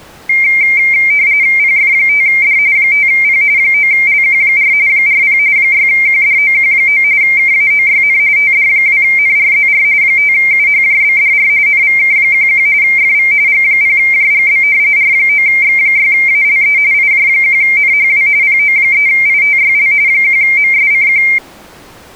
RTTY (45.45 baud, 170 Hz shift), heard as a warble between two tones, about 2200 Hz centre. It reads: PF5D 5P 9LQ4 40 6QDOQ9 KAOYN TD2NRZR 5UHJBDR NVK11 FV G0JGB R9X6ALE IJ1NHW PO3ITYL 1MSCQ